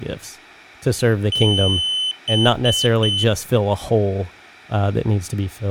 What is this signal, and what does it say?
Beep code, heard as a piezo beeper, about 3050 Hz, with speech in English. 1 long, 3 short. In Award and IBM BIOS tables: video adapter failure; in AMI BIOS tables: memory failure.